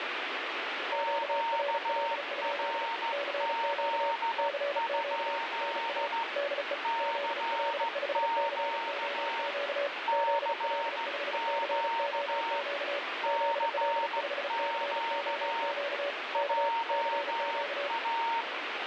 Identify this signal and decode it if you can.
Morse code, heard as two keyed tones, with heavy radio static. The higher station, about 15 wpm, 920 Hz: QRZ? CQ CQ CQ JA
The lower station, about 35 wpm, 570 Hz: QRL? CQ CQ NA DE ZL5COQ ZL5COQ ZL5COQ K CQ